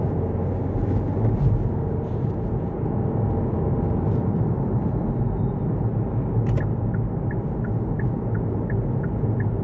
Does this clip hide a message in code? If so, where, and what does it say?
No, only the noise inside a car.